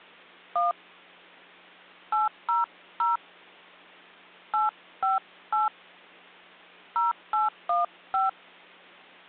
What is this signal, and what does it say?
DTMF, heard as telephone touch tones, dialled by hand, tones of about 160 ms. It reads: 1 800 858 0815